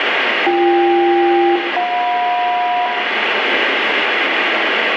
Aircraft SELCAL, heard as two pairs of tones, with radio static and room echo. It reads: BK-JM